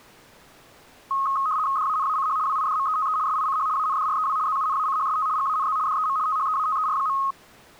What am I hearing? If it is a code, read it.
RTTY (75 baud, 170 Hz shift), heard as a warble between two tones, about 1170 Hz centre. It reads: DANACH WIDMETE SICH ANDREW ZUNACHST GANZ DEM THEATER.